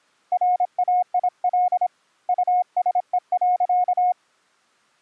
Morse code, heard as a keyed tone, hand-sent with a paddle, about 26 wpm, 720 Hz. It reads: RAIL USE.